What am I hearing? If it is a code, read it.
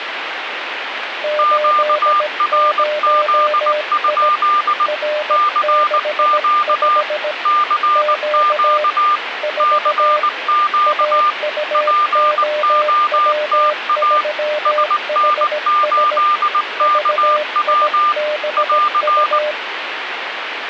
Morse code, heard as two keyed tones, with radio static. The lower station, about 17 wpm, 600 Hz: 80I R65 Q 4 AUOW3HS VIBU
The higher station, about 19 wpm, 1200 Hz: QRZ? CQ CQ CQ POTA SN8KW <AR>